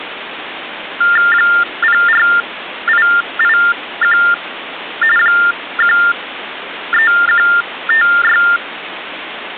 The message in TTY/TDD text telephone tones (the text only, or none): 04881 13156